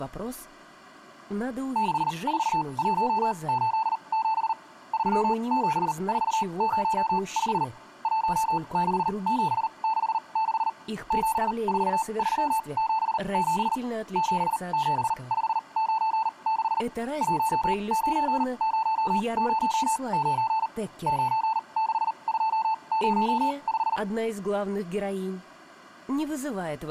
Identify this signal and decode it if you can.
Morse code, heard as a keyed tone, machine-sent, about 39 wpm, spaced as for 29 wpm, 880 Hz. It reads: 64187 37405 16766 74377 77596 19009 96205